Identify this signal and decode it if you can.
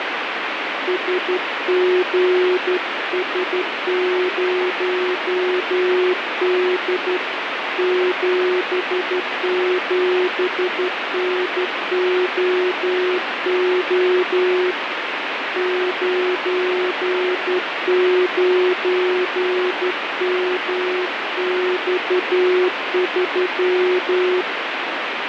Morse code, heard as a keyed tone, hand-sent with a straight key, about 12 wpm, 360 Hz, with radio static. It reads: SGS0D 77NOO 99MX3